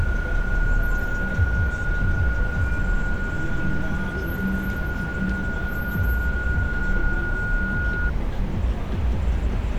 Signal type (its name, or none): PSK31